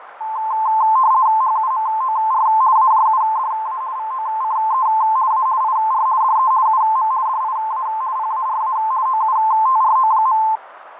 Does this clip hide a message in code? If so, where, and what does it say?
Yes: RTTY (50 baud, 170 Hz shift) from 0.2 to 10.6 s, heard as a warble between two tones, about 960 Hz centre, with radio static, fading and a narrow filter. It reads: HUMOR AJUDA VOCE A IR DE UM DIA PARA OUTRO.